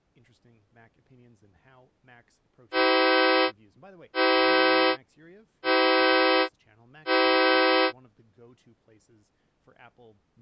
Train horn signal, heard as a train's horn, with speech in English. 4 short. On North American railways: a request for a signal to be given or repeated.